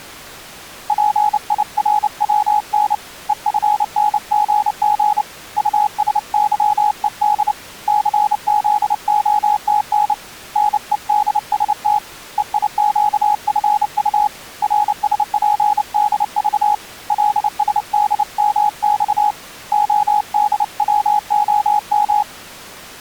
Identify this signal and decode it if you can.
Morse code, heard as a keyed tone, hand-sent with a paddle, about 29 wpm, 840 Hz. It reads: PIRWN EFNGG USYED CZOTN NEDST EIQFU RSPDV LSDMX ODWOM